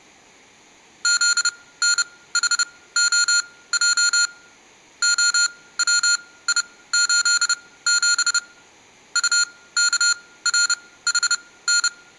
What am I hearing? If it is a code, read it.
Morse code, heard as electronic beeps, machine-sent, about 30 wpm, spaced as for 18 wpm, 1410 Hz. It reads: ZNHOJ OWI87 UKRHN